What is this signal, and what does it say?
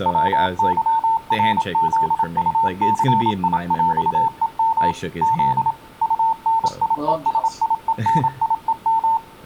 Morse code (with Polish letters), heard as a keyed tone, machine-sent, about 27 wpm, 900 Hz, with speech in English. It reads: WYRZUCIŁEM Z UNIESIENIEM